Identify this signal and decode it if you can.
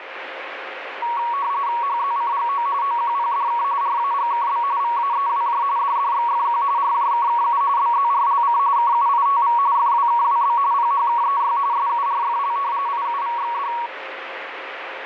RTTY (45.45 baud, 170 Hz shift), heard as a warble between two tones, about 1030 Hz centre, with radio static. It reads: HZCGO OQPDK RAGKB VAEWJ DDXFQ RJKKU BZRLC KUITV FWKWB PHKEY SURFL IUVXD